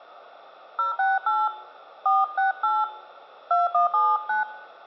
DTMF, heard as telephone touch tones, dialled by hand, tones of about 160 ms, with hum. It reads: 068 468 2179